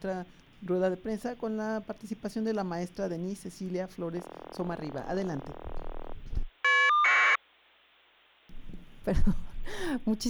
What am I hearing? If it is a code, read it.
Caller ID data burst, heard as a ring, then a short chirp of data, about 1200 baud.